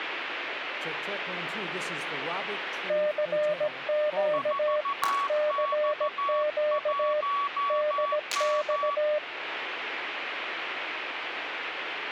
Morse code, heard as two keyed tones, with radio static. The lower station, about 17 wpm, 600 Hz: CQ CQ DX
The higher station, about 14 wpm, 1130 Hz: 4X1M